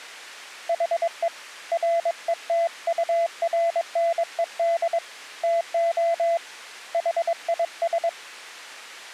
Morse code, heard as a keyed tone, hand-sent with a paddle, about 22 wpm, 680 Hz. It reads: HE RETURNED TO HIS